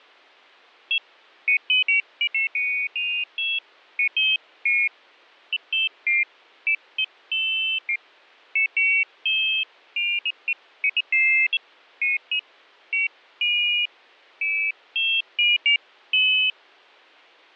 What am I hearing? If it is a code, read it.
Pairs of high tones at irregular times, with fading. There is no code.